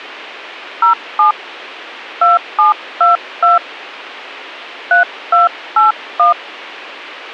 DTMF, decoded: 07 2722 3281

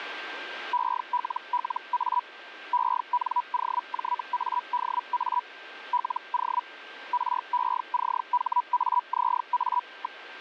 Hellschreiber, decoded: ELLA ENOJADA LO RECHAZA.

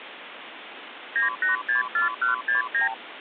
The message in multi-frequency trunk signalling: 9864169

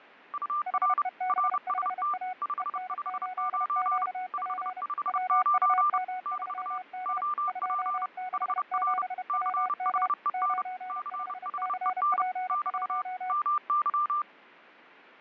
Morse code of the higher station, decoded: UR RST 559 559 <BT> OP HR CHEN CHEN <BT> MY

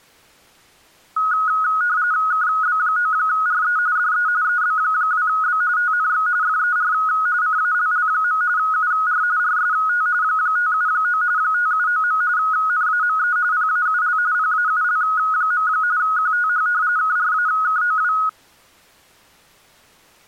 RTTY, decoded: KB9RE DE EB2B TNX FER CALL. UR RST 579 579. NAME PAUL PAUL. QTH KRAKOW

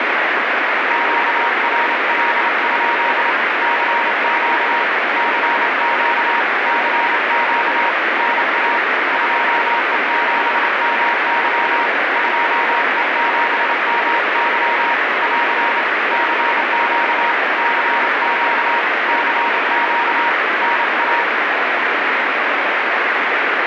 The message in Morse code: QRL? CQ CQ CQ NA 2E7MY 2E7MY <AR> CQ CQ CQ NA

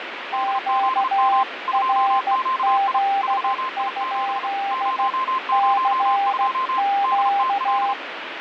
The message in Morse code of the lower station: QRZ? CQ

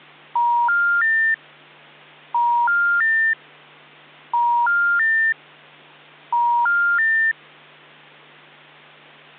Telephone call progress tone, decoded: special information tone

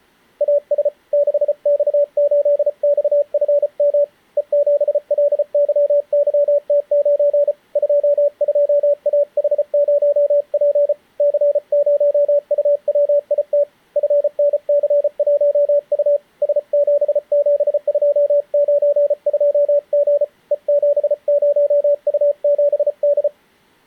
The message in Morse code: AS 6X8XFM E7LYYT9 22AH0P C0UWIT FNC1U S77292G E70U7D

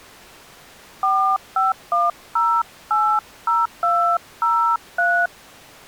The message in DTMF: 451080203

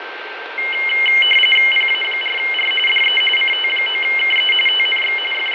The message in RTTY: PA4R DE CT9KE TNX …

